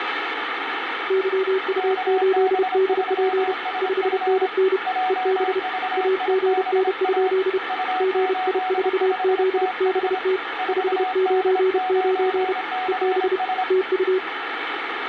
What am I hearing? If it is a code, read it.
Morse code, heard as two keyed tones, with radio static. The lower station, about 31 wpm, 380 Hz: YU8DP 5NN EB AGN? GI4ZBT 599 EB TU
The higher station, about 26 wpm, 740 Hz: KB3SF JVIBA U85TH 4D9CS